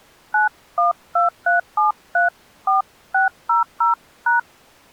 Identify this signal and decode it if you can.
DTMF, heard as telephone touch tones, dialled by hand, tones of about 140 ms. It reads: 9123734600#